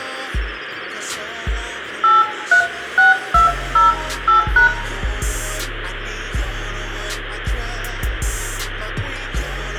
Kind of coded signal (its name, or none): DTMF